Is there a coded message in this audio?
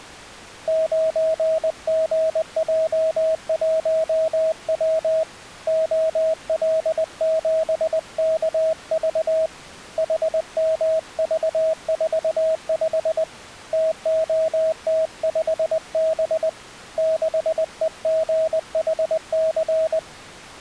Yes: Morse code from 0.6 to 20.1 s, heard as a keyed tone, hand-sent with a paddle, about 20 wpm, 640 Hz. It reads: 9GJ1W OL7KV HMV45 TOT5B 6EGHC